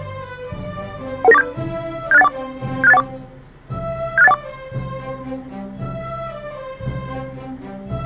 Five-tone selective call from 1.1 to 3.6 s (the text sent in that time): 11947 76814 76814